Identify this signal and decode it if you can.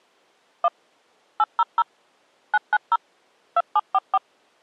DTMF, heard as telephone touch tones, dialled by machine, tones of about 40 ms. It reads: 1 800 990 2744